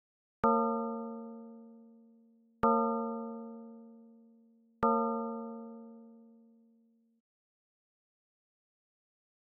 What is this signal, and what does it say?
Clock strike, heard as a bell. 3. Three o'clock.